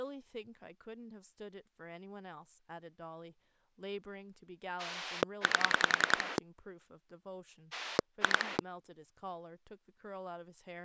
Pulse dialling, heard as a rotary dial, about 10 pulses a second, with speech in English. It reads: 8 2